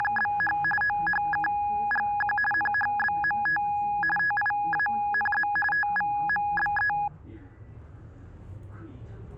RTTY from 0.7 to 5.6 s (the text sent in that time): OHKGQ NHBMT TIANZ